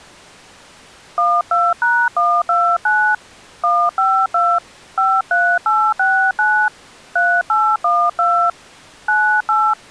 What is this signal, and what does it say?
DTMF, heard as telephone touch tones, dialled by hand, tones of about 280 ms. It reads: 12#129 152 53869 3812 98